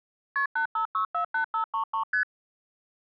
Multi-frequency trunk signalling (R1, as on North American trunks), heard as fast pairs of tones, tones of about 100 ms. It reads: KP 85648533 ST